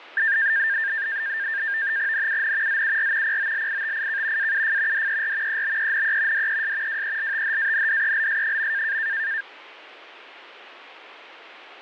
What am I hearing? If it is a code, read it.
NAVTEX (SITOR-B), 100 baud, 170 Hz shift, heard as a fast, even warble, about 1700 Hz centre. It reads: NUN ZUR POLITIK AUF DER EBENE DES WELTHANDELS.